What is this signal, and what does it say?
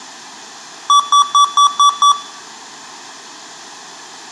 Beep code, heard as beeps from a small speaker, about 1150 Hz, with room echo. 6 short. In AMI BIOS tables: keyboard controller gate A20 failure; in Dell tables: video card failure.